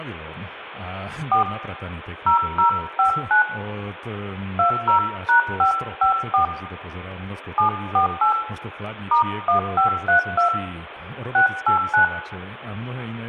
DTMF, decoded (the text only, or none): 4 0059 20#554 748 *1532 689